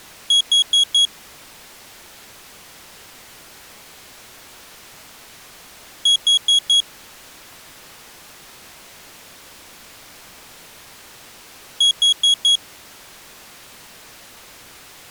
Alarm pattern, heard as an alarm's beeps, played three times, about 3300 Hz. Temporal four. Carbon monoxide.